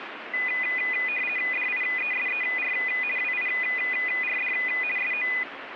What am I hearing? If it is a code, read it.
RTTY (50 baud, 450 Hz shift), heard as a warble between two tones, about 2250 Hz centre, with radio static. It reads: DIESER WIRD SO